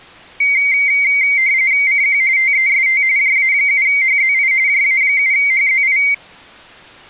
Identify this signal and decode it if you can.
RTTY (45.45 baud, 170 Hz shift), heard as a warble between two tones, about 2150 Hz centre. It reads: CQ TEST JA7HZI JA7HZI